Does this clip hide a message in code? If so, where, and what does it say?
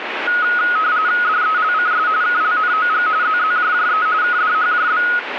Yes: RTTY (45.45 baud, 170 Hz shift) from 0.3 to 5.2 s, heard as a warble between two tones, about 1360 Hz centre, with radio static. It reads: DELCS KLNOG ZZJJE KDHJB